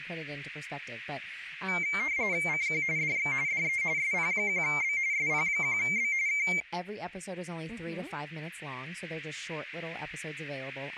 RTTY (45.45 baud, 170 Hz shift), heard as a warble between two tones, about 2200 Hz centre, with radio static and speech in English. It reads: CQ DX DE SP1B SP1B K